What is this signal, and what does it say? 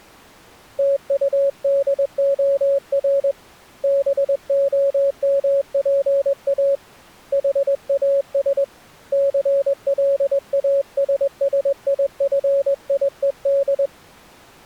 Morse code, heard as a keyed tone, hand-sent with a straight key, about 21 wpm, 560 Hz. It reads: TUDOR BOMPA HAS CLASSIFIED